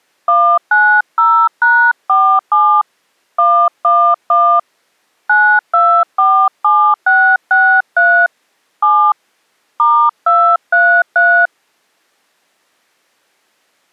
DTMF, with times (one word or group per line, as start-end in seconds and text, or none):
0.3-2.8 190#47
3.4-4.6 111
5.3-8.3 9247663
8.8-9.1 7
9.8-11.5 *233